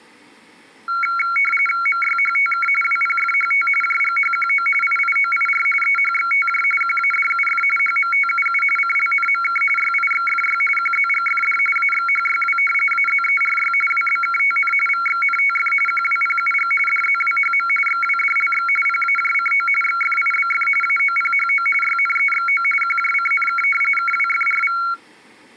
RTTY (45.45 baud, 850 Hz shift), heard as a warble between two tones, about 1800 Hz centre. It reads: MYHTK WPFHT JGHQO IIOIR EHXTJ QADUF HMTUU CLNMK YIXFY QZGFD AXHYW AZERY WBKTN VXNTF QWPUG DZWHM XWDLX PAJCO XFIBF AOPHO YNEXO QJCNK KWFRV